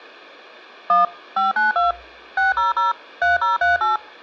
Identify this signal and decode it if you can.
DTMF, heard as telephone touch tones, dialled by machine, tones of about 150 ms. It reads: 1 592 600 3038